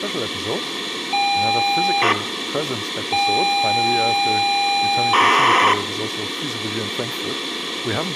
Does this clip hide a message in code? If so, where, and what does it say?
Yes: ZX Spectrum tape loading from 1.1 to 5.7 s, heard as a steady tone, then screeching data, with tape hiss and room echo.